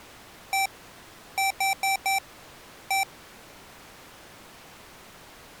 Beep code, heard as beeps from a small speaker, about 780 Hz. 1-4-1. In Phoenix BIOS tables: address line failure in the first 64 KB of memory.